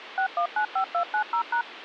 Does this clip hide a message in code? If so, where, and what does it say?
Yes: DTMF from 0.2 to 1.6 s, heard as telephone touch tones, dialled by machine, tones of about 90 ms, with phone line noise. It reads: 6195290#